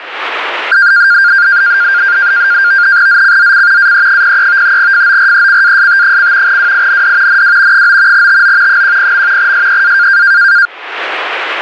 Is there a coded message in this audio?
Yes: NAVTEX (SITOR-B), 100 baud, 170 Hz shift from 0.7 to 10.7 s, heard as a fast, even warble, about 1500 Hz centre, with radio static. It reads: ZCZC AE03 FORECAST: WIND NW 9 TO 10. SEA